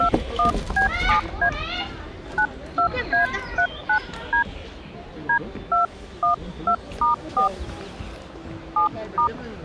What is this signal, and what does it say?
DTMF, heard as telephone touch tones, dialled by hand, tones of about 110 ms, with the noise of a park. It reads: 21B7A 92A39D D212*4 7*